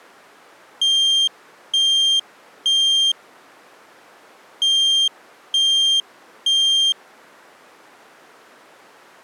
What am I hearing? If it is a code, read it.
Alarm pattern, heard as an alarm's beeps, played twice, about 3200 Hz. Temporal three. Smoke or fire, evacuate.